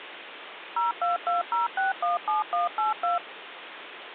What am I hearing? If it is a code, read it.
DTMF, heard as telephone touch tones, dialled by machine, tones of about 150 ms, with phone line noise. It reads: 0220617182